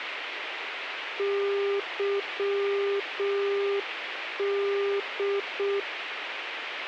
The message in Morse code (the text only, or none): YD